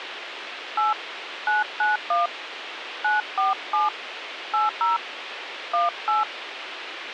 DTMF, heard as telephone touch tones, dialled by hand, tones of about 160 ms, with radio hiss. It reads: 8 991 947 80 18